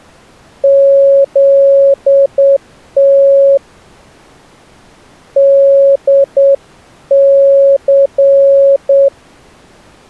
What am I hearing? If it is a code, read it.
Morse code, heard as a keyed tone, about 8 wpm, 550 Hz. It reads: ZT DC